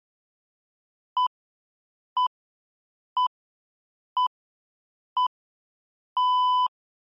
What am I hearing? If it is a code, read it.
Radio time signal (six pips, as the Greenwich Time Signal), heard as pips.